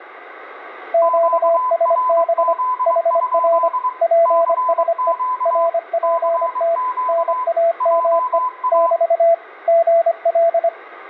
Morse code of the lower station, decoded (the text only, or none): QSB HR PSE RPT NAME <BT> GL